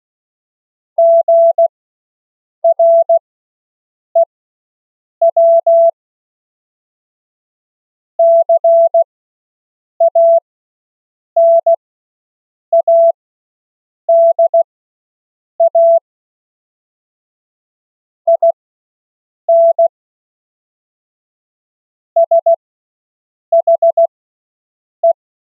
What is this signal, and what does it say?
Morse code, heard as a keyed tone, machine-sent, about 16 wpm, spaced as for 7 wpm, 670 Hz. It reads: GREW CANADA IN SHE